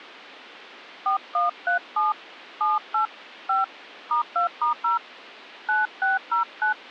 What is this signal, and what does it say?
DTMF, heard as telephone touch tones, dialled by hand, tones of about 150 ms. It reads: 4137 78 5 *2*0 9609